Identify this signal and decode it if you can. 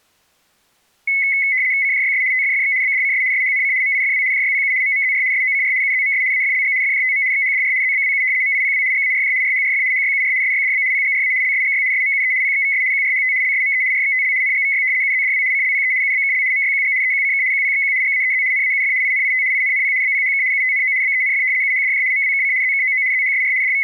RTTY (75 baud, 170 Hz shift), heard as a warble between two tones, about 2100 Hz centre. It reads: CJYS TFFX BDCS SHNC MIFW JYPU MMZR SOCR UZMS AFLG FJTM XHDR ZBWU MIPW GARJ RHRF HYUR SYDB PGRA LSGY SMUE PXVS QRHT LSME RXTL NGVY UZDW CLPE UBKL MYQG EQCK QPXQ GAEZ NAUF INIT INNP BPHK UTNO BENF UHDJ MWKC ZKOO ZHSR …